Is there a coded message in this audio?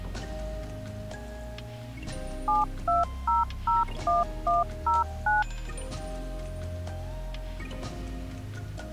Yes: DTMF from 2.5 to 5.4 s, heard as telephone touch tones, dialled by machine, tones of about 160 ms. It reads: 72001109